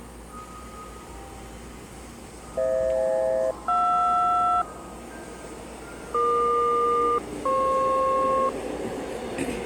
Aircraft SELCAL, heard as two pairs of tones, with the noise of a subway station. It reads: FH-JR EQ-FP